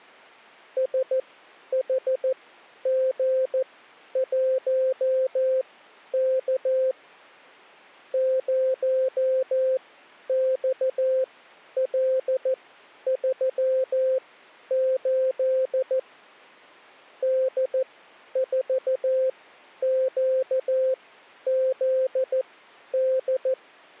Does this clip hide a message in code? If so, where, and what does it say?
Yes: Morse code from 0.7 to 23.6 s, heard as a keyed tone, machine-sent, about 14 wpm, spaced as for 10 wpm, 520 Hz. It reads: SHG1K 0XL38 D4QZD